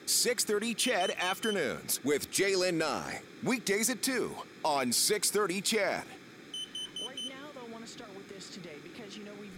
Alarm pattern, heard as an alarm's beeps, played twice, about 3050 Hz, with room echo and speech in English. Temporal four. Carbon monoxide.